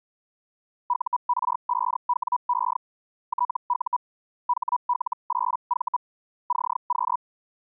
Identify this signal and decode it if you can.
Hellschreiber (Feld-Hell, 122.5 baud), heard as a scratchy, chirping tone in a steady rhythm, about 980 Hz. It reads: UR5WE TU HL8V CQ